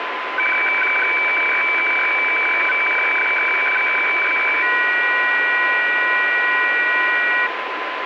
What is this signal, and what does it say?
Weather fax (radiofax), 120 lines a minute, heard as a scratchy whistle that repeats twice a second, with radio static and a steady whistle near 1020 Hz.